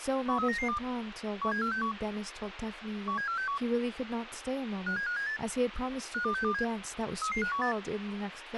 Five-tone selective call (CCIR), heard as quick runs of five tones, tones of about 100 ms, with radio hiss, a squelch burst at the end and speech in English. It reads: 13992 17461 17461 57578 52627 33518